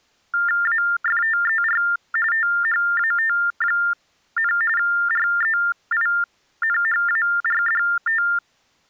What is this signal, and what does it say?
TTY/TDD text telephone tones (45.45 baud Baudot), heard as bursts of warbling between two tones, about 400 Hz shift, 1600 Hz centre. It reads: AFTER THAT, REINHARDT